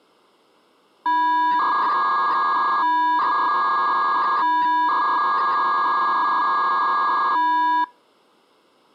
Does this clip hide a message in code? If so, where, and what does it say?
Yes: 300-baud modem data (V.21 tones) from 1.1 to 7.8 s, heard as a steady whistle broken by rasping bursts, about 300 baud, 200 Hz shift.